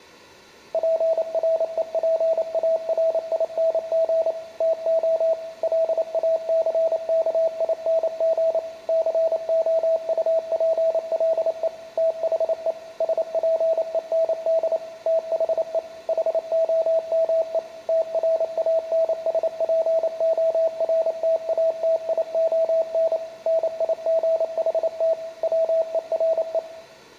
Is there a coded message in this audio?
Yes: Morse code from 0.7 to 26.6 s, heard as a keyed tone, machine-sent, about 28 wpm, 650 Hz, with room echo. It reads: PREPARING TO LACKING COUPLE THE SPEND THE HOME TRANSPORTATION NIGHT WERE